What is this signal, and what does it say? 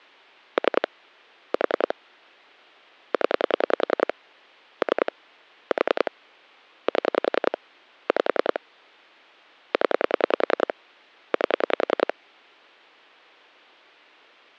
Pulse dialling, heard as clicks on a phone line, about 10 pulses a second. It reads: 3 4 0 3 4 7 5 0 8